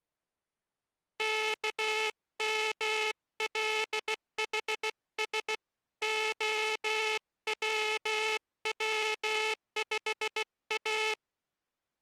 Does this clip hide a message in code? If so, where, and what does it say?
Yes: Morse code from 1.1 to 11.2 s, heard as a buzzer, hand-sent with a bug key, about 16 wpm. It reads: KMLHS OWW5A